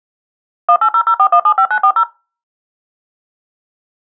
DTMF, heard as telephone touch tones, dialled by machine, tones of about 70 ms. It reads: 18004175940